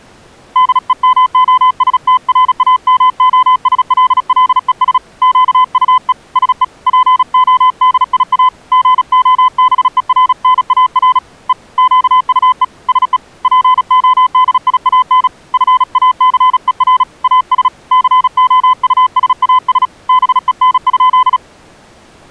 Morse code, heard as a keyed tone, hand-sent with a paddle, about 36 wpm, 1020 Hz. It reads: DEMOSTRAMOSLLES QUE SE PODIA GOBERNAR E QUE SE PODIAN FACER AS COUSAS BEN?